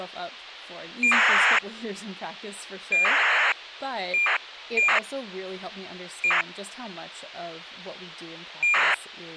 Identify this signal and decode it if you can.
ACARS aircraft data, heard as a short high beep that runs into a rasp, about 2400 baud, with radio hiss and speech in English.